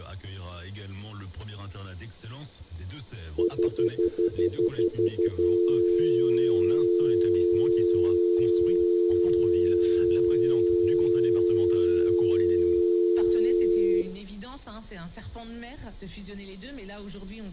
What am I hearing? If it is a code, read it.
Telephone call progress tone (North American plan), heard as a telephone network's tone, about 350, 440 Hz, 0.1 s on and 0.1 s off, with room echo. Stutter dial tone.